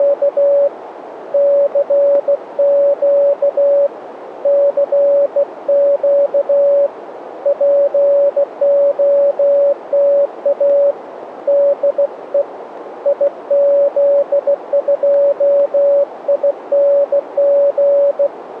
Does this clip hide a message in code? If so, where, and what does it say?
Yes: Morse code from 0.0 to 18.3 s, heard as a keyed tone, hand-sent with a bug key, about 16 wpm, 570 Hz, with radio static and a narrow filter. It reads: … CQ CQ POTA DE IZ2ING